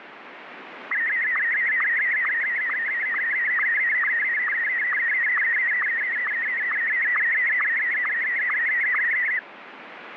SSTV (slow-scan television), Martin M1, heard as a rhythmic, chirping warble, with radio static.